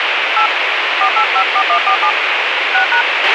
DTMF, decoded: 8 4854147 6#

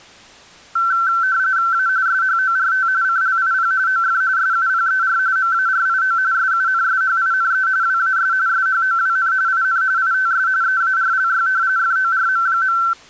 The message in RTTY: A SHORT CLIP OF SUPER MARIO SUNSHINE WAS SHOWN IN ITS EARLY FORM.

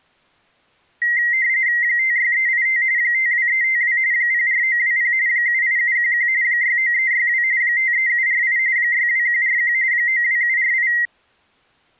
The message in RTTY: 56385 52352 04920 78711 69362 53748 62141 92748

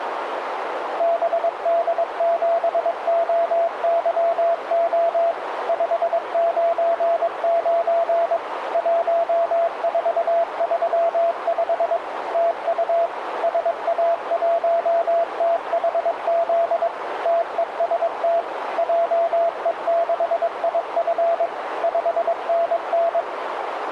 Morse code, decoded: BD7OYO 599 1435 TU SA1THZ TEST JE6IF 5NN

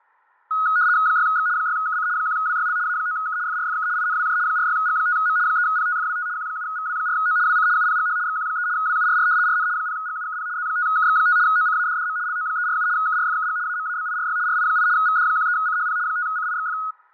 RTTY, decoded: 6X 6KC 1WYL A9K FRFK INWJ 46G5M 3PTFWT Q7VW4O WC UPGH XQ3 WURR RN 0GUKP Z5KX5 OCADDM LO347 KRFKG AMABIRY RI8 VD13CHP 5CIXF

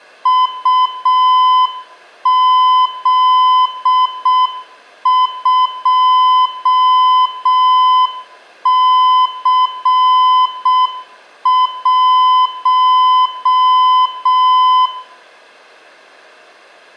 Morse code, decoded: UZ2C1

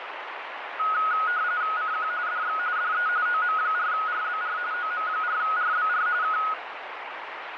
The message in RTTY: CQ DX DE OM4RBR OM4RBR K

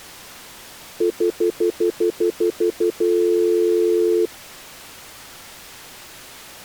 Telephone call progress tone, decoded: stutter dial tone

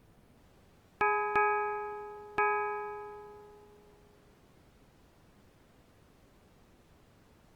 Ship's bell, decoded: 3

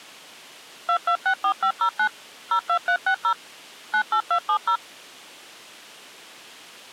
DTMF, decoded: 2264509 02360 98270

